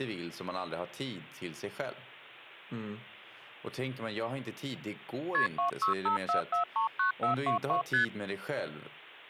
Multi-frequency trunk signalling (R1, as on North American trunks), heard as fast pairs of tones, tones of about 120 ms, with speech in Swedish. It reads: KP 2654439422 ST